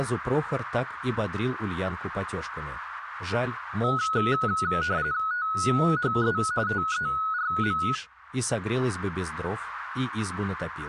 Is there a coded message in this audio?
Yes: RTTY (45.45 baud, 170 Hz shift) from 3.8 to 8.0 s, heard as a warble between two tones, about 1370 Hz centre, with radio static. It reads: THE TERM